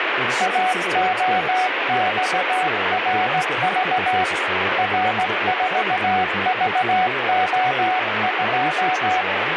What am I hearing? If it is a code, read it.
Morse code, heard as a keyed tone, hand-sent with a straight key, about 17 wpm, 740 Hz, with radio static and speech in English. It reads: AOXRV R4VO2